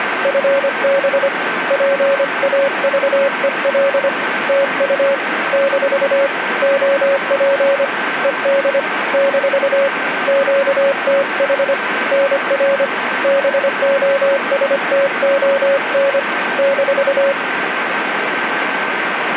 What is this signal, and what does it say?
Morse code, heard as a keyed tone, hand-sent with a paddle, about 25 wpm, 550 Hz, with radio static and a steady whistle near 1550 Hz. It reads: FB PAVEL TU - OP ED - QTH NR BOSTON -